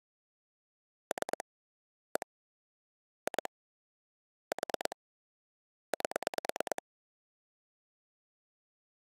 Pulse dialling, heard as clicks on a phone line, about 9 pulses a second. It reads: 3 1 2 4 8